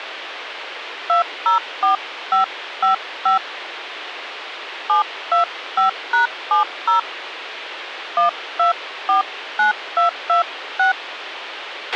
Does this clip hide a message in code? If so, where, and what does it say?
Yes: DTMF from 1.1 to 10.9 s, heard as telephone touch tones, dialled by hand, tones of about 120 ms, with radio hiss and a squelch burst at the end. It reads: 204555 725#70 1249226